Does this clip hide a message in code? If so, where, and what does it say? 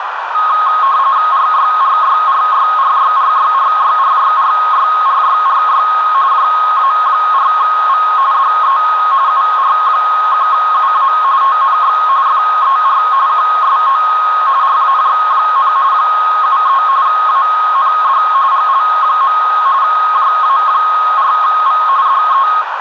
Yes: RTTY (45.45 baud, 170 Hz shift) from 0.3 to 22.6 s, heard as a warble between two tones, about 1170 Hz centre, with radio static and a narrow filter. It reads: RYRYRYRYRYRYRYRYRYRY JA4V DE UR1UA TNX FER QSO RAJ, 73 AND GL. JA4V DE